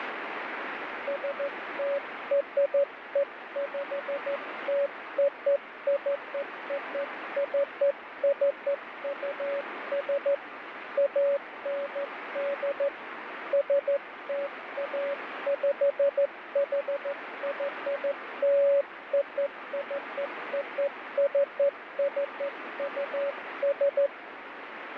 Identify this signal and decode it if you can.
Morse code (American railroad code), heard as a keyed tone, hand-sent with a straight key, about 560 Hz, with radio static. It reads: STREPTOCOCCUS AND STAPHYLOCOCCUS